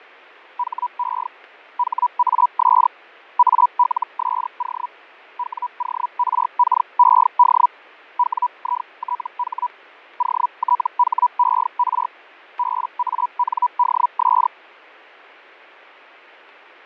Hellschreiber (Feld-Hell, 122.5 baud), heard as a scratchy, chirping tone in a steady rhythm, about 980 Hz, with fading. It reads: HE HAS ALSO WORKED WITH OTHER BANDS